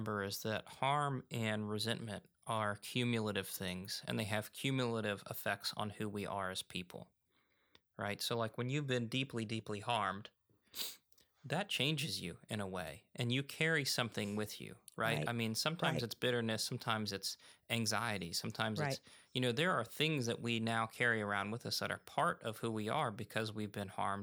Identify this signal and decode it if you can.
Speech in English. There is no code.